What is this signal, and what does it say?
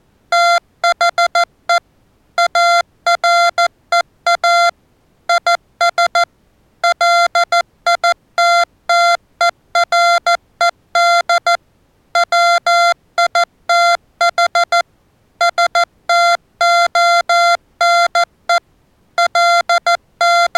Morse code, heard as electronic beeps, machine-sent, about 14 wpm, 690 Hz. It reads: THE AREA IS LITTERED WITH STONE …